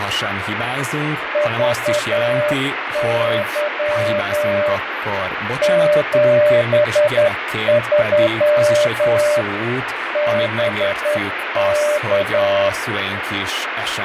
Morse code, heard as a keyed tone, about 10 wpm, 600 Hz, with radio static and speech in Hungarian. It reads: VY 73 BK